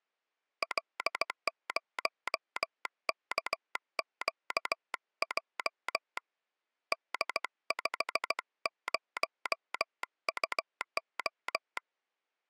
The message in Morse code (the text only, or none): L0KQJ D50UO